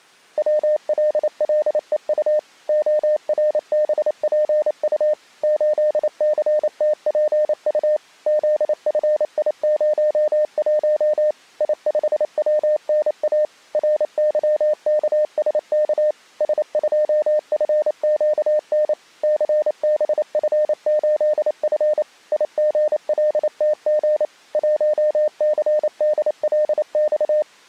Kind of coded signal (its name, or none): Morse code